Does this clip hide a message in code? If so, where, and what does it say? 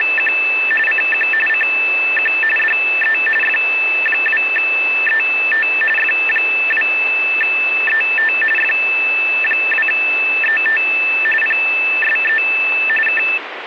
Yes: RTTY (45.45 baud, 850 Hz shift) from 0.0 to 13.4 s, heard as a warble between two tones, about 2200 Hz centre, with radio static. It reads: … CQ CQ DE F2ET F2ET F2ET PSE K